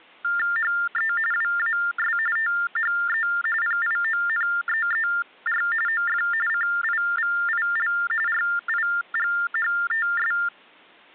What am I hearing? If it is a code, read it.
TTY/TDD text telephone tones (45.45 baud Baudot), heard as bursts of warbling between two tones, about 400 Hz shift, 1600 Hz centre. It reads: HE WAS THE PIONEER OF CIVIL RIGHTS